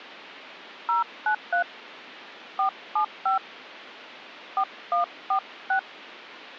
DTMF, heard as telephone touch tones, dialled by hand, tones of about 110 ms. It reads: 093 475 4146